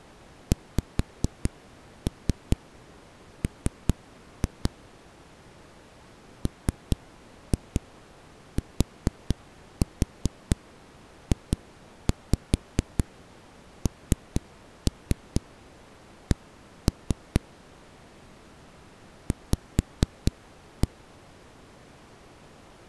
Tap code, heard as knocks on a wall, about 4 knocks a second. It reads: XM MTJNC V